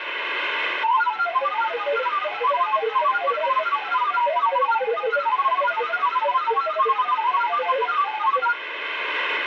Multi-tone FSK (Olivia or MFSK type), about 1000 Hz wide, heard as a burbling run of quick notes, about 31.25 baud, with radio static.